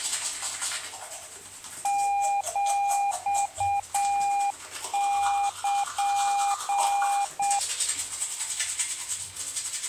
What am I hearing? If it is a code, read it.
Morse code (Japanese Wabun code), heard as a keyed tone, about 7 wpm, 800 Hz, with the noise of a restroom. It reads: ヒル